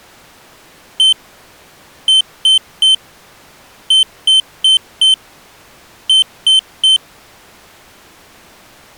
Beep code, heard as a piezo beeper, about 3100 Hz. 1-3-4-3. In Phoenix BIOS tables: memory failure on data bits.